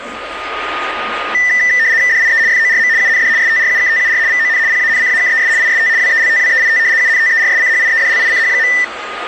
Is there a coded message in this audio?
Yes: RTTY (75 baud, 170 Hz shift) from 1.3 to 8.8 s, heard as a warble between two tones, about 1900 Hz centre, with a steady whistle near 1230 Hz and the noise of a cafe. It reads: DIE FORM UND STRUKTUR VON PANCAKES IST WELTWEIT UNTERSCHIEDLICH.